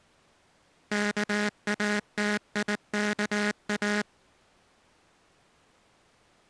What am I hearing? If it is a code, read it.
Morse code, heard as a buzzer, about 19 wpm. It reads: KATIKA